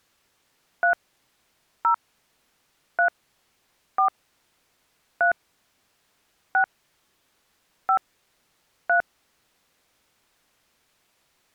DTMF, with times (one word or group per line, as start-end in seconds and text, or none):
0.8-0.9 3
1.8-1.9 0
3.0-3.1 3
4.0-4.1 4
5.2-5.3 3
6.5-6.6 6
7.9-8.0 5
8.9-9.0 3